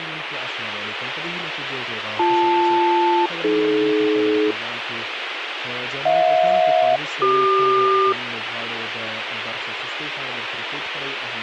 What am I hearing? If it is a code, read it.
Aircraft SELCAL, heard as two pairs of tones, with radio hiss. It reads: BL-AD HJ-CQ